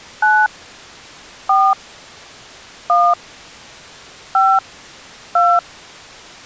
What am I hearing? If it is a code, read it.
DTMF, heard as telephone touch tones, dialled by hand, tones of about 240 ms. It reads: 9 4 1 5 2